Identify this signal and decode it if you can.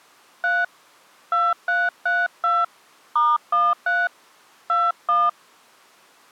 DTMF, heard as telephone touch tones, dialled by hand, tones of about 210 ms. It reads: 3 2332 *13 21